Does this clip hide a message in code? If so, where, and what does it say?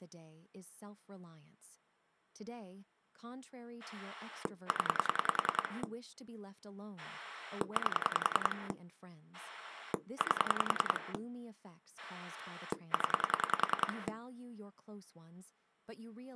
Yes: pulse dialling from 3.8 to 14.1 s, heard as a rotary dial, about 10 pulses a second, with speech in English. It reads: 0 8 8 0